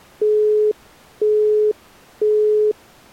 Telephone call progress tone (single-tone plan, as in Europe, Japan and elsewhere), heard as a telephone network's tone, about 420 Hz, 0.5 s on and 0.5 s off. Busy tone.